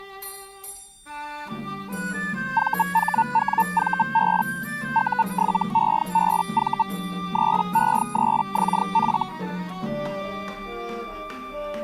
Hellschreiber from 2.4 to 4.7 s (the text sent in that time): VHWVB